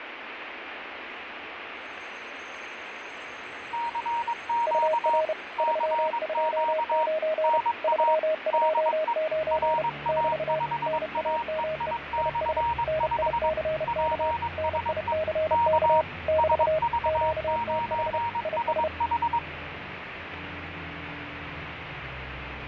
Morse code, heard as two keyed tones, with radio static and fading. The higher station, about 22 wpm, 940 Hz: CQ CQ NA DE RA5AEI/5 PSE K SV9SH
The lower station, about 31 wpm, 630 Hz: UR 329 329 <BT> NAME IS NICK NICK <BT> QTH IS